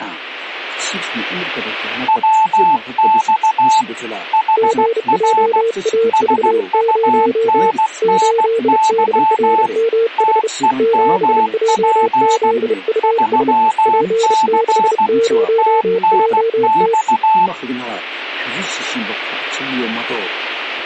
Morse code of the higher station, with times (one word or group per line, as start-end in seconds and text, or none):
2.1-3.8 WX
4.3-5.6 HR
6.1-9.7 SUNNY
10.2-12.5 TEMP
13.0-15.1 3C
15.6-17.5 TNX